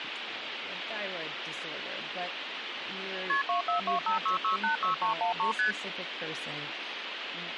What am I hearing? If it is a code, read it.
Multi-frequency trunk signalling (R1, as on North American trunks), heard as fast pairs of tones, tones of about 120 ms, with phone line noise and speech in English. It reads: KP 24256686313 ST